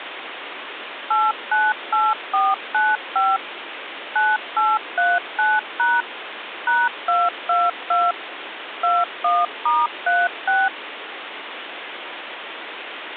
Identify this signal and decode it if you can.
DTMF, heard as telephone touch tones, dialled by machine, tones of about 210 ms, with phone line noise. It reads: 898495 9839# #222 21*36